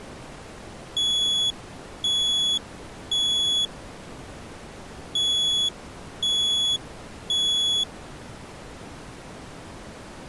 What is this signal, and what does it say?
Alarm pattern, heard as an alarm's beeps, played twice, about 3400 Hz. Temporal three. Smoke or fire, evacuate.